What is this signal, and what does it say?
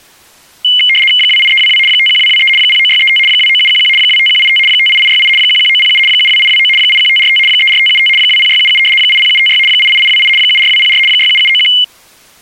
RTTY (75 baud, 850 Hz shift), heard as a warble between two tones, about 2550 Hz centre. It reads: 28322 51223 09635 29711 25185 58868 11907 72829 81545 34575 20677 80756 88828 74204 67791